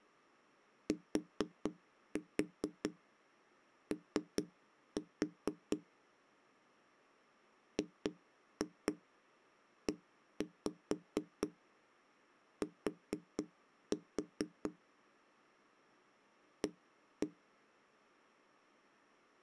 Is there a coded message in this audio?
Yes: tap code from 0.9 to 17.3 s, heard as knocks on a wall, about 4 knocks a second. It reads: TO GET A